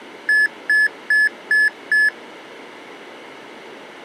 Beep code, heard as beeps from a small speaker, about 1700 Hz. 5 short. In AMI BIOS tables: processor failure; in Dell tables: CMOS battery failure.